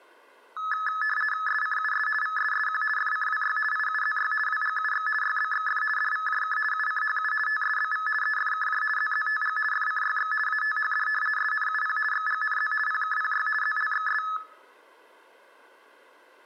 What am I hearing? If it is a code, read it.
RTTY (50 baud, 450 Hz shift), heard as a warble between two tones, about 1500 Hz centre. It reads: SCUS VSSQ FCWY IUZY WGUX YBXF DVJK UCHU TSBV EFKJ ZZTG FCYX ATHD SNUP XGNZ PKPY ZLXS